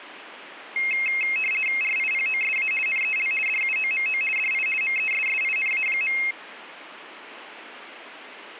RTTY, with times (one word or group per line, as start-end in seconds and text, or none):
1.8-2.7 RIPOSA
2.9-3.3 NEL
3.5-4.2 DUOMO
4.4-4.7 DI
4.8-6.2 MESSINA.